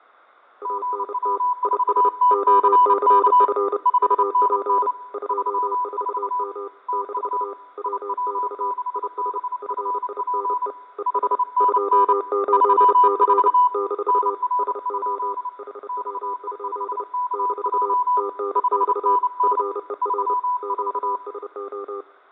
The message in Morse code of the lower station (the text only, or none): ANT IS OCF UP 24M - WX IS FINE ES 28C - SO HW? - TNX FER QSO